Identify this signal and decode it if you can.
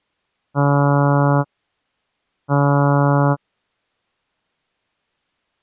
Ship horn signal, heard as a ship's horn, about 140 Hz. 2 short. At sea: I am altering course to port.